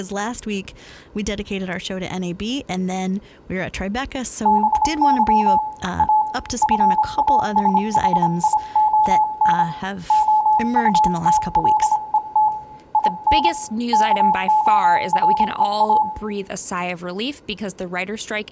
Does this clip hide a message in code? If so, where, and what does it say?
Yes: Morse code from 4.4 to 16.1 s, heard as a keyed tone, hand-sent with a paddle, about 26 wpm, 860 Hz, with room echo and speech in English. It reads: BY A FASHION OUTLET IN KOREA